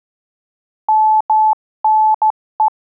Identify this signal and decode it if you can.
Morse code (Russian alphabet), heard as a keyed tone, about 14 wpm, 870 Hz. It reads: МНЕ